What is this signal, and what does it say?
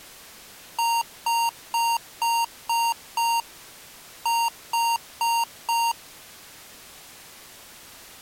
Beep code, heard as beeps from a small speaker, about 930 Hz. 6-4.